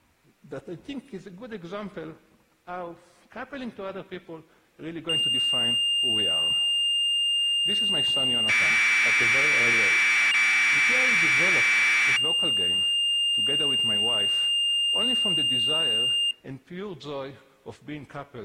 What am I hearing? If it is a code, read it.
Commodore tape loading (standard loader), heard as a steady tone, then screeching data.